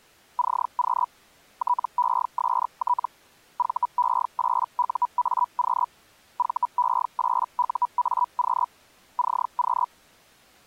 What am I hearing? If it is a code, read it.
Hellschreiber (Feld-Hell, 122.5 baud), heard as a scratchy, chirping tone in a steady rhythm, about 980 Hz. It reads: CQ TEST VE8UAQ VE8UAQ CQ